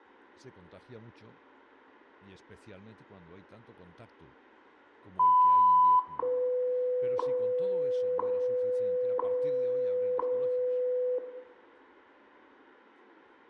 Radio time signal (WWV, Colorado), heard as ticks, one a second, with room echo.